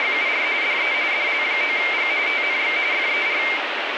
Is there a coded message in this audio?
Yes: RTTY (45.45 baud, 170 Hz shift) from 0.0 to 3.6 s, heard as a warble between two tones, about 2200 Hz centre, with radio static. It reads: … DE DL9G TNX FER